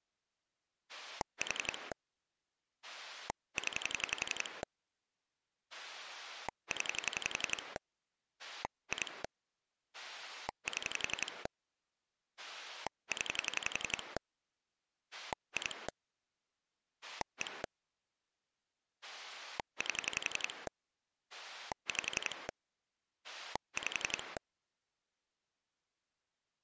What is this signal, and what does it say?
Pulse dialling, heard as a rotary dial, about 11 pulses a second. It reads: 4 0 0 2 7 0 2 1 8 5 5